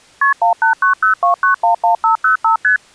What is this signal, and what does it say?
Multi-frequency trunk signalling (R1, as on North American trunks), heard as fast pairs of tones, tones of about 120 ms. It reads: KP 18902911505 ST